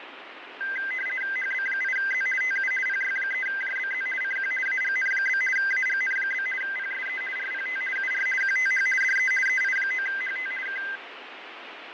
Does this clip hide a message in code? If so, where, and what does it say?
Yes: RTTY (50 baud, 450 Hz shift) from 0.6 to 11.0 s, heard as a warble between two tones, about 1800 Hz centre, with radio static and fading. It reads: HB8Z TU PY3JBZ CQ AGN? AGN? PSE RPT UR QTH DE EI9HT K